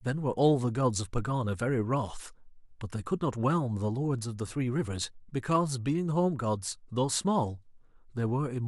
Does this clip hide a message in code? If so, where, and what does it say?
No, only speech in English.